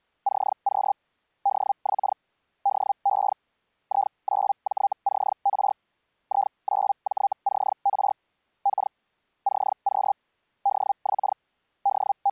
Hellschreiber (Feld-Hell, 122.5 baud), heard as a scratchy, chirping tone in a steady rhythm, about 800 Hz. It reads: CQ DX DE I9JCR I9JCR K CQ DX …